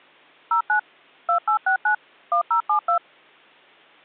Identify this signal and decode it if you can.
DTMF, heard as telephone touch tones, dialled by machine, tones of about 100 ms. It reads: 09 2869 1072